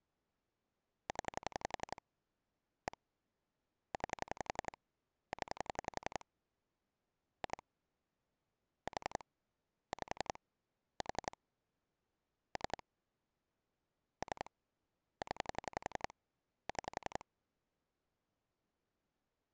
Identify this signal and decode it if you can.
Pulse dialling, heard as clicks on a phone line, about 11 pulses a second. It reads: 0 1 9 0 2 4 5 4 3 3 0 6